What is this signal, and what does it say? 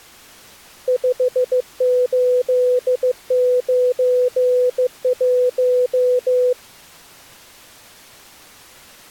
Morse code, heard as a keyed tone, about 15 wpm, 500 Hz. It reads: 5891